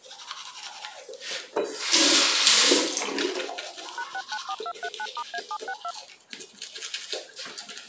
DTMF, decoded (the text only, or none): #694239*A762